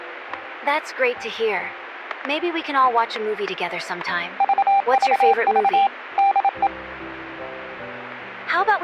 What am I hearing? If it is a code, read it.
Morse code, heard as a keyed tone, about 27 wpm, 790 Hz, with static crashes. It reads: VVV DE